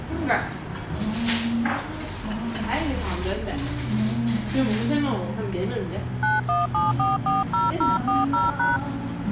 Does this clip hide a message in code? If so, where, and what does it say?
Yes: DTMF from 6.2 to 8.8 s, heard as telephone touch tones, dialled by hand, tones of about 170 ms, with the noise of a restaurant. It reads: 917440040#